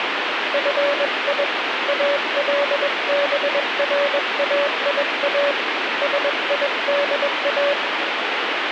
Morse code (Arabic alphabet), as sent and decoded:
..-. .. / .- .-.. -... .-. .- .. .- / ... .. -.. .-
في البرايا سيدا

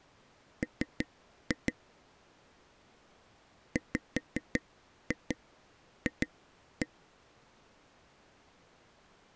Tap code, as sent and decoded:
3-2 / 5-2 2-1
M WF

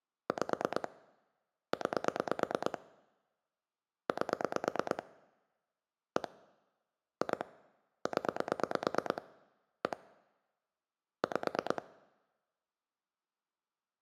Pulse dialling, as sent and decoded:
5 / 9 / 8 / 1 / 2 / 10 / 1 / 5
5 9 8 1 2 0 1 5

